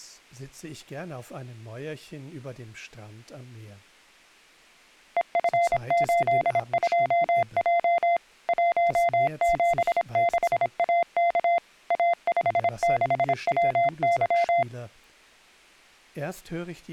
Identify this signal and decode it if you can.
Morse code, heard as a keyed tone, machine-sent, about 26 wpm, 690 Hz. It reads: EF82J 176AK A56WY